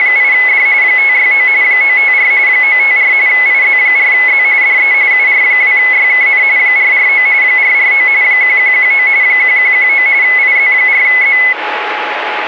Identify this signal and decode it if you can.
RTTY (45.45 baud, 170 Hz shift), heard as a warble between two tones, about 2100 Hz centre, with radio static and a steady whistle near 840 Hz. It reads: … 569 954 954 IZ4Z DE UR2YKN 449 449 1119 1119 IZ4Z